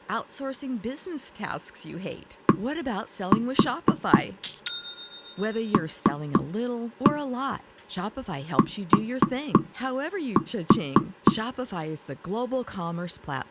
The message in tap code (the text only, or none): DLT